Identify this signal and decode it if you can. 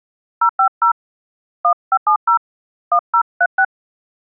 DTMF, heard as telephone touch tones, dialled by hand, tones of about 80 ms. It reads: 050 1570 1036